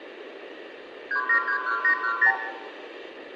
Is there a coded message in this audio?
Yes: multi-frequency trunk signalling (R2, with the far end's replies) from 1.1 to 2.4 s, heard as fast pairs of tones, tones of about 90 ms, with room echo. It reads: 3731810